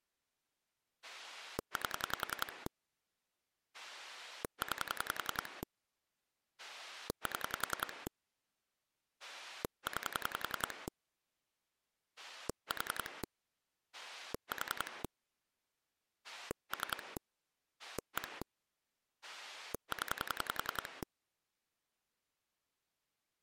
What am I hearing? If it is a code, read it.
Pulse dialling, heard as a rotary dial, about 10 pulses a second. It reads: 8 9 7 9 4 4 3 1 0